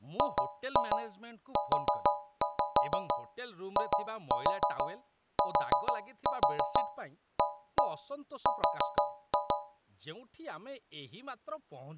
Tap code, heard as taps on a metal pipe, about 6 knocks a second, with speech in Odia. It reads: GUITAR